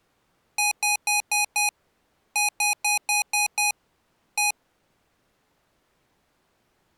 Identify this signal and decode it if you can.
Beep code, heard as beeps from a small speaker, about 830 Hz. 5-6-1.